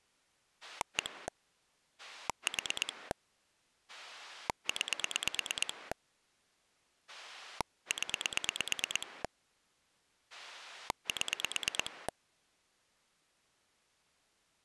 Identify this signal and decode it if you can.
Pulse dialling, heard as a rotary dial, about 9 pulses a second. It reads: 1 4 9 0 7